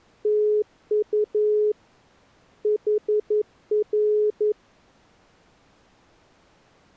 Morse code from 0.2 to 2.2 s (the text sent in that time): TU